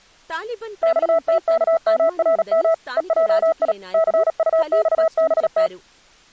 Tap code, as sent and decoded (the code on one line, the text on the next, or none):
none